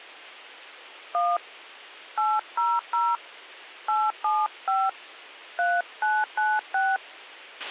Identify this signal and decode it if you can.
DTMF, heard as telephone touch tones, dialled by hand, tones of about 220 ms, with a squelch burst at the end. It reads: 1 800 875 3996